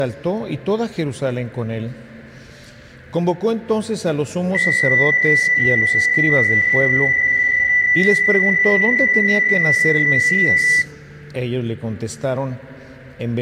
PSK63 (62.5 baud), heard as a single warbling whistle, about 2000 Hz.